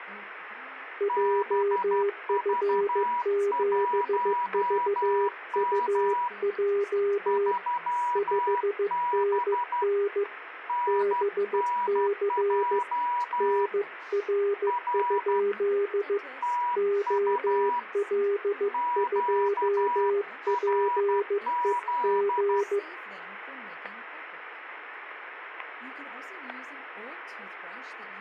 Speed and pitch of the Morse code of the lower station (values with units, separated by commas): 15 wpm, 400 Hz